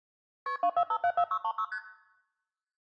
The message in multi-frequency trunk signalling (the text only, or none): KP 24574636 ST